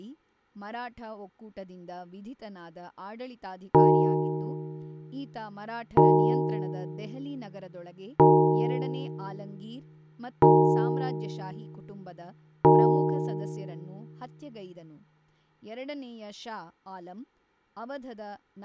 Clock strike, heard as a bell, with speech in Kannada. 5. Five o'clock.